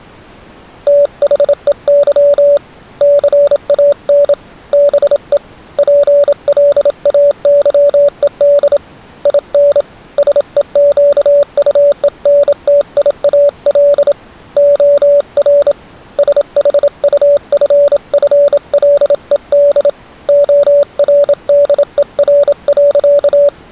Morse code, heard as a keyed tone, hand-sent with a bug key, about 27 wpm, 570 Hz. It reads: THEY CAN BE PLAYED IN SEQUENTIAL OR SHUFFLED ORDER.